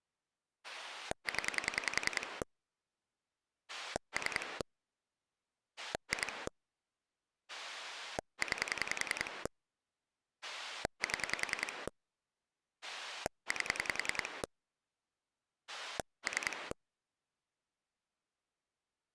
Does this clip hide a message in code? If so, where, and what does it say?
Yes: pulse dialling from 0.6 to 16.7 s, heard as a rotary dial, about 10 pulses a second. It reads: 0 3 2 9 7 8 3